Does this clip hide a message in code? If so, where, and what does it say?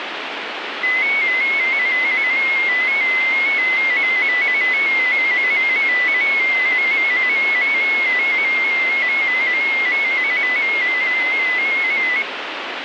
Yes: multi-tone FSK (Olivia or MFSK type), about 250 Hz wide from 0.8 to 12.2 s, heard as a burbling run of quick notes, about 15.625 baud, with radio static.